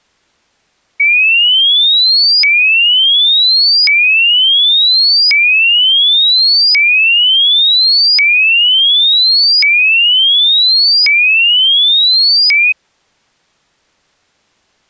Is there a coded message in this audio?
No, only a tone that sweeps in pitch again and again.